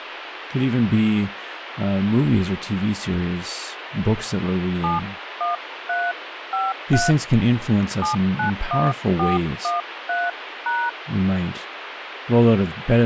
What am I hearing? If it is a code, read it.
DTMF, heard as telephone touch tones, dialled by hand, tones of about 170 ms, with radio hiss and speech in English. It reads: 71353 791413#